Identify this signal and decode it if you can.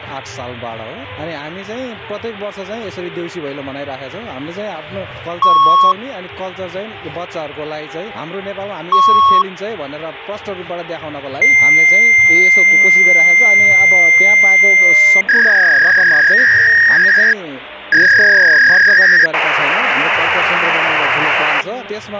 Fax machine handshake, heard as beeps, a long tone, a warble and hiss, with phone line noise.